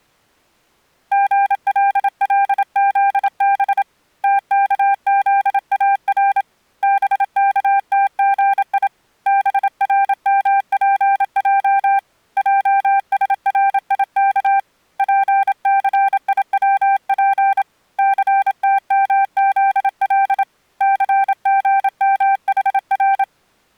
Morse code (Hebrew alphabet), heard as a keyed tone, hand-sent with a paddle, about 27 wpm, 790 Hz. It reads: גללזב תכזאר בכתגי ברמפע עשריך פסיצף סתמזל סגמחר